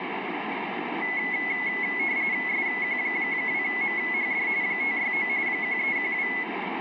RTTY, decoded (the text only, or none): SQ2MHD 569 1312